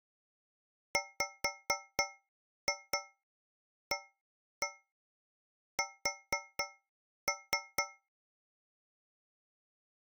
Tap code, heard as taps on a metal pipe, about 4 knocks a second. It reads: WAS